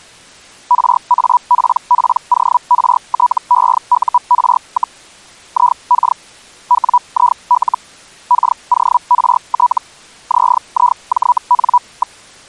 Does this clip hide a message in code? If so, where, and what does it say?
Yes: Hellschreiber (Feld-Hell, 122.5 baud) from 0.7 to 12.2 s, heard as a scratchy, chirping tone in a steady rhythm, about 980 Hz. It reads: RAPPORTEUR, IK WIL KORT ZIJN.